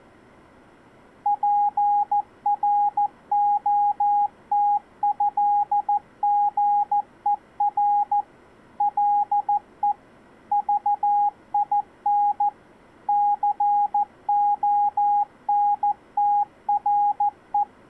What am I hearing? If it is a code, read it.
Morse code (with French letters), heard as a keyed tone, machine-sent, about 14 wpm, 820 Hz. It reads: PROTÉGER LE VIN CONTRE